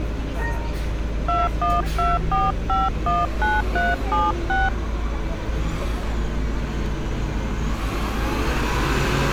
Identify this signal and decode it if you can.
DTMF, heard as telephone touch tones, dialled by hand, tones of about 190 ms, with street noise. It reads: 2124519376